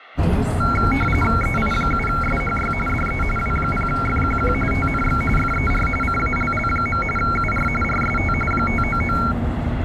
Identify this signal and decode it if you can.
RTTY (45.45 baud, 850 Hz shift), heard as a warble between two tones, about 1800 Hz centre, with radio static and the noise inside a bus. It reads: EI7SHY DE W0FQQ TNX FER CALL. UR RST 599